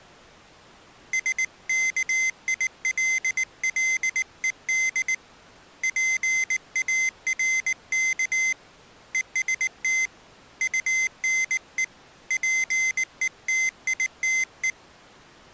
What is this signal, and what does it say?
Morse code, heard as a high beeper, hand-sent with a paddle, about 19 wpm, 2050 Hz. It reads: SKILLED PARK EST UNE PETITE